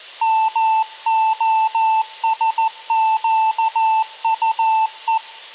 Morse code, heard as a keyed tone, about 14 wpm, 880 Hz, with room echo. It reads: MOSQUE